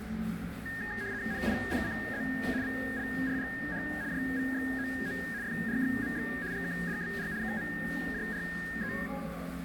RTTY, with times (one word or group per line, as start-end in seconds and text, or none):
1.3-2.2 NIPCZ
2.6-3.8 VLRGH
4.1-5.2 JVXOO
5.4-6.3 FRXMX
6.5-7.3 GKDBR
7.4-8.9 KMJRE